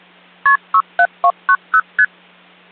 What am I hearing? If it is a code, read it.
Multi-frequency trunk signalling (R1, as on North American trunks), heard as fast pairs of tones, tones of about 60 ms, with hum. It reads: KP 67290 ST